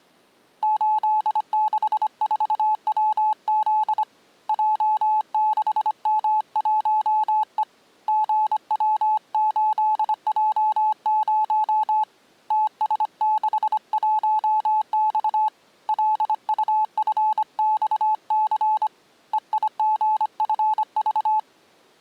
Morse code, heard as a keyed tone, hand-sent with a bug key, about 25 wpm, 860 Hz. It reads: 864WZ J6M1E GW8J0 TS61X LUFXC EIGFV